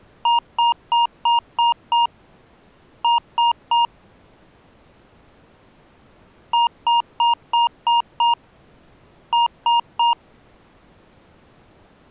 Beep code, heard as beeps from a small speaker, played twice, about 940 Hz. 6-3.